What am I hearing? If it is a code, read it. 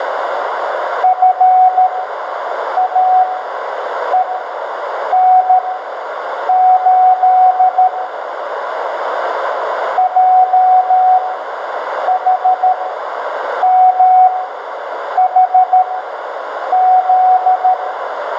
Morse code, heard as a keyed tone, machine-sent, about 13 wpm, spaced as for 7 wpm, 740 Hz, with radio static, a narrow filter and room echo. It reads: FAEN8 JHMHZ